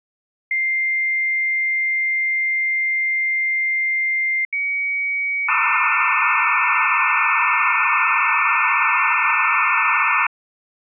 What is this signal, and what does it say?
Dial-up modem handshake (low-speed, two carriers), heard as two whistles, then hiss.